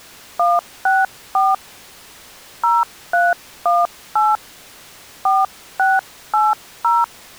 DTMF, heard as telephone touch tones, dialled by hand, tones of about 200 ms. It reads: 164 0318 4680